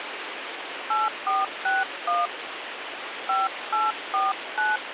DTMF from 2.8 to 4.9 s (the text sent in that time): 5849